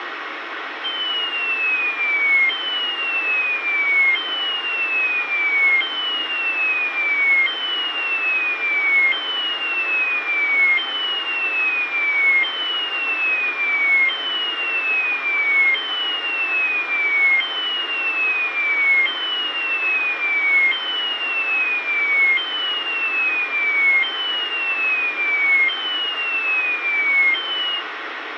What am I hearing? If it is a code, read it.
A tone that sweeps in pitch again and again, with radio hiss. There is no code.